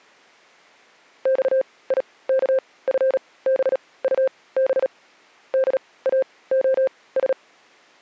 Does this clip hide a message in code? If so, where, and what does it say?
Yes: Morse code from 1.2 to 7.4 s, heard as a keyed tone, machine-sent, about 37 wpm, spaced as for 21 wpm, 530 Hz. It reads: XIKFBUB DAOS